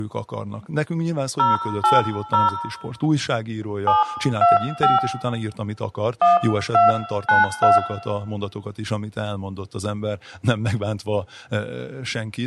DTMF, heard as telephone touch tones, dialled by hand, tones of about 160 ms, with room echo and speech in Hungarian. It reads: 080 725 1292